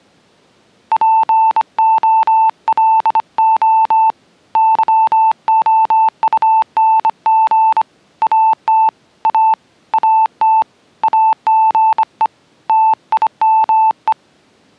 Morse code, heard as a keyed tone, hand-sent with a bug key, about 25 wpm, 880 Hz. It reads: POLO YOUNG AT A AT AGE TIME